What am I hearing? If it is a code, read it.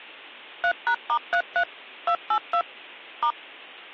DTMF, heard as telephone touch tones, dialled by machine, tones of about 80 ms. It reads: 3#*33 282 *